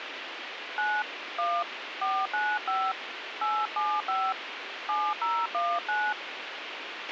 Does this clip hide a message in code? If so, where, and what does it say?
Yes: DTMF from 0.8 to 6.1 s, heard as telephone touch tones, dialled by hand, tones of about 240 ms, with radio hiss and a squelch burst at the end. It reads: 9 1 495 875 7019